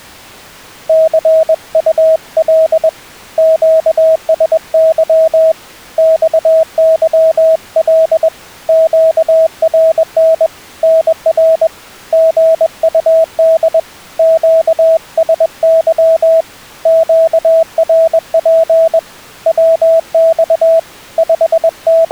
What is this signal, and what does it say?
Morse code, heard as a keyed tone, hand-sent with a paddle, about 21 wpm, 650 Hz. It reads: CUL QSY XYL QRN NR GUD QSY QRP WX …